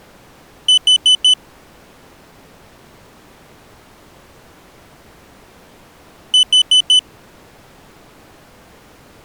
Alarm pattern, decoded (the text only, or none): temporal four